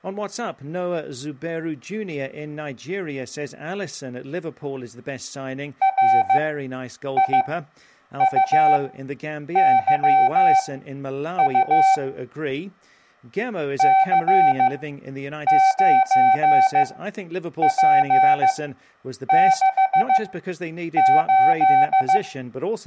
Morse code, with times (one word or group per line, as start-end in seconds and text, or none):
5.8-11.9 RIUYU
13.8-22.2 C9P68